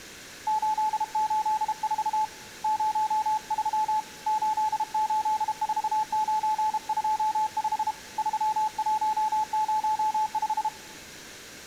Morse code, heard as a keyed tone, hand-sent with a paddle, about 32 wpm, 860 Hz, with room echo. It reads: 884 03 884925 3105